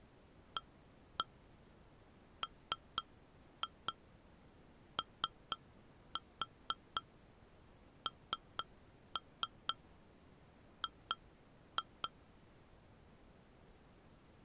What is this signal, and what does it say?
Tap code, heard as taps on glass, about 4 knocks a second. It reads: AMONG